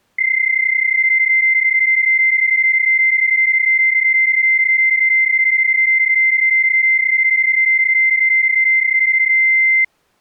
PSK31 (31.25 baud), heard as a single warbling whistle, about 2100 Hz.